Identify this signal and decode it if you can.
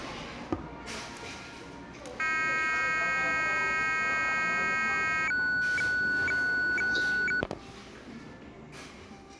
Weather fax (radiofax), 120 lines a minute, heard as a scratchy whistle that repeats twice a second, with the noise of a cafe.